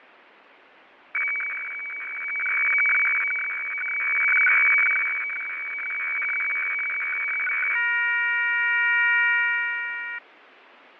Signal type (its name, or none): weather fax (radiofax)